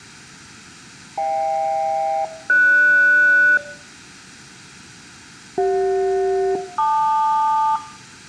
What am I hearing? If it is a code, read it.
Aircraft SELCAL, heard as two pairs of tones, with room echo. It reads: HK-GS CJ-LQ